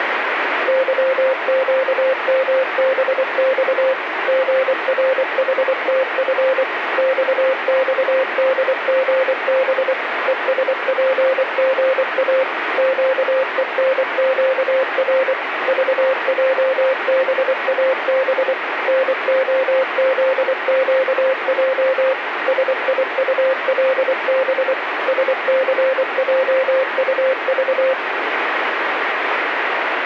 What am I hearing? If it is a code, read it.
Morse code, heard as a keyed tone, machine-sent, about 24 wpm, 530 Hz, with radio static. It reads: YQMBX GRHTF XXDGB ESPGA QENQR VJBAB NOZQJ SIULB SCJUV